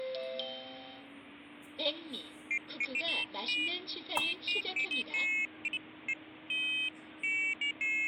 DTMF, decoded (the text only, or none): none